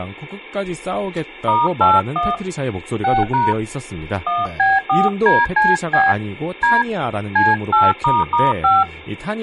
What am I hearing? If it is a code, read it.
DTMF, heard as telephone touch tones, dialled by hand, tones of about 190 ms, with speech in Korean. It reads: *81 6# 1B4DCB D C8**5